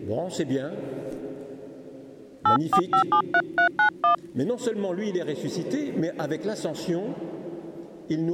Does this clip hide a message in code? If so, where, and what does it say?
Yes: DTMF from 2.5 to 4.1 s, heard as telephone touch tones, dialled by hand, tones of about 80 ms. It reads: 84573391